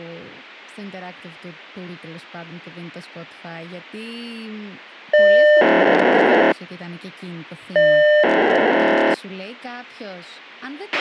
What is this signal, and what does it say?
POCSAG pager data (1200 baud), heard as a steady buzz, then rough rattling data, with a squelch burst at the end and speech in Greek.